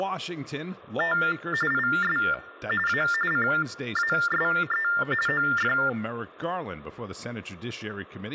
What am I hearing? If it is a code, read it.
TTY/TDD text telephone tones (45.45 baud Baudot), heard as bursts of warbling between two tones, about 400 Hz shift, 1600 Hz centre, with hum and speech in English. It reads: … IS A CASE OF